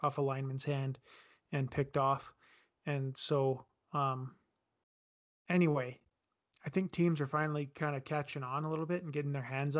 Speech in English. There is no code.